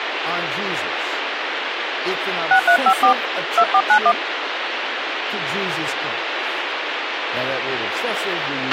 DTMF, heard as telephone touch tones, dialled by hand, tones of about 80 ms, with radio hiss, a squelch burst at the end and speech in English. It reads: 6354 2491